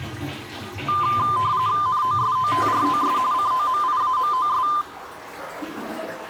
RTTY (45.45 baud, 170 Hz shift), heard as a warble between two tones, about 1110 Hz centre, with the noise of a restroom. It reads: NOSOTROS COMIAMOS